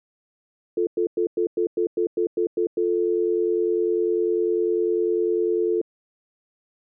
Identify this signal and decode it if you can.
Telephone call progress tone (North American plan), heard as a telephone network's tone, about 350, 440 Hz, 0.1 s on and 0.1 s off. Stutter dial tone.